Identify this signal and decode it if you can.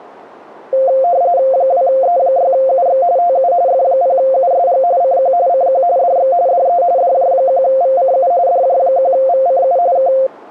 RTTY (45.45 baud, 170 Hz shift), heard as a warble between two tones, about 620 Hz centre. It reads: 2E6UX TU F0USG CQ CQ DX DE DJ1VCU DJ1VCU K